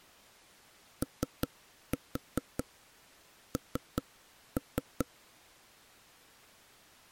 Tap code, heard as knocks on wood, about 4 knocks a second. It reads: ON